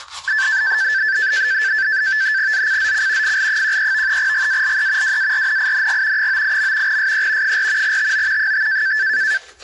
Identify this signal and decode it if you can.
NAVTEX (SITOR-B), 100 baud, 170 Hz shift, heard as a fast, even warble, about 1650 Hz centre, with the noise of a restroom. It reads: ZCZC FL13 GALE WARNING 98. SE 4 TO 5